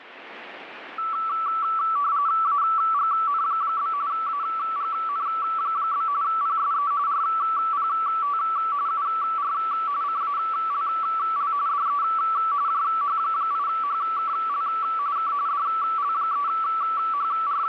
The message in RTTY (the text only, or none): AGN? AGN? PSE RPT UR CALL DE JH8HKL K …